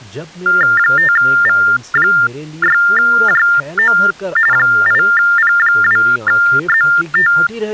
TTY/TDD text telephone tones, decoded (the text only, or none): 5V6JO 8P2ZT